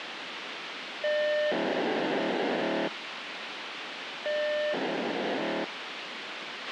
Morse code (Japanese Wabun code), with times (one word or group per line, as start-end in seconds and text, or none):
none